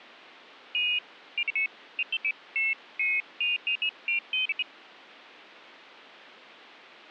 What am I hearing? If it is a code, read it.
Pairs of high tones at irregular times. There is no code.